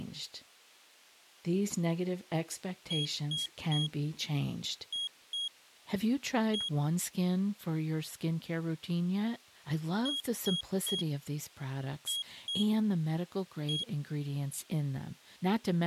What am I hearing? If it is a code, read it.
Beep code, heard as a piezo beeper, played twice, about 3300 Hz, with speech in English. 3-2-1.